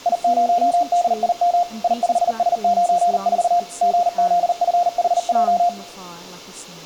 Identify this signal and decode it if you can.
Morse code, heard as a keyed tone, machine-sent, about 39 wpm, 700 Hz, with speech in English. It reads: I0DIM I5S94 GZFHJ